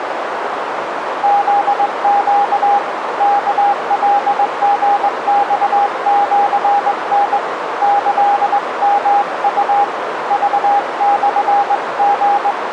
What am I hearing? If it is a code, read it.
Morse code (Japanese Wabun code), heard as a keyed tone, hand-sent with a straight key, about 20 wpm, 810 Hz, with radio static and a narrow filter. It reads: フネ ワカリマシタ キヨウ クモリ